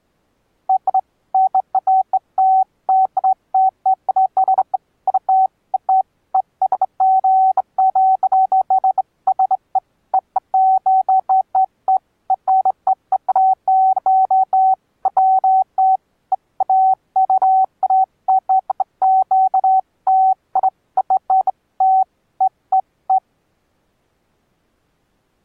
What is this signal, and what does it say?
Beeps of irregular length. There is no code.